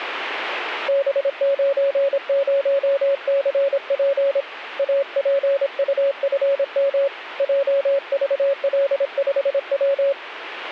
Morse code, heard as a keyed tone, hand-sent with a paddle, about 26 wpm, 560 Hz. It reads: B90CP APUFM JVL5W